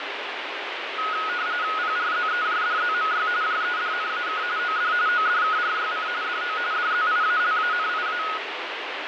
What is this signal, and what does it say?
RTTY (45.45 baud, 170 Hz shift), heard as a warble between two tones, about 1360 Hz centre, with radio static. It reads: PRZEJDZMY JEDNAK OD ODKRYC DO DZIALANIA